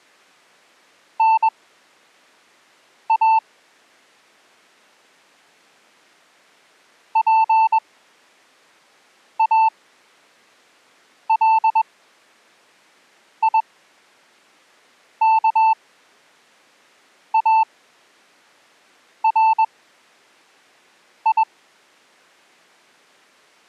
Morse code (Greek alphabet), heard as a keyed tone, machine-sent, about 21 wpm, spaced as for 5 wpm, 890 Hz. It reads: ΝΑ ΠΑΛΙΚΑΡΙ